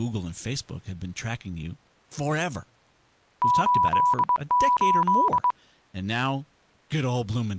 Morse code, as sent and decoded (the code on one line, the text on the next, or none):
---.. ---..
88